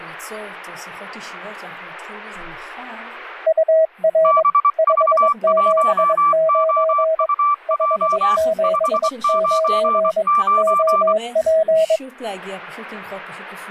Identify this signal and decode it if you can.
Morse code, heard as two keyed tones. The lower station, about 22 wpm, 640 Hz: UR 579 579 OP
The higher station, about 24 wpm, 1170 Hz: BV1OUJ 599